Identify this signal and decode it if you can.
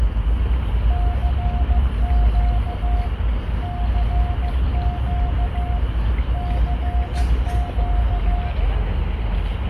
Morse code, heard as a keyed tone, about 15 wpm, 710 Hz, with radio static, room echo and the noise of a park. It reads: CQ CQ CQ